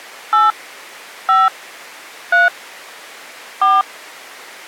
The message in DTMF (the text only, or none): 8 5 3 4